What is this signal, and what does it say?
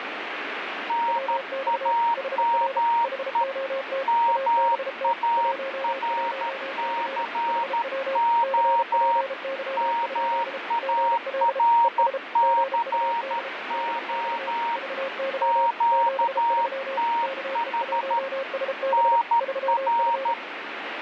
Morse code, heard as two keyed tones, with radio static. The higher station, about 13 wpm, 930 Hz: NAME MARCO MARCO QTH NR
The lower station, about 33 wpm, 540 Hz: WX HR HOT ABT 11C HW CPY? GL ES GUD DX VY 73 KE1SB 3F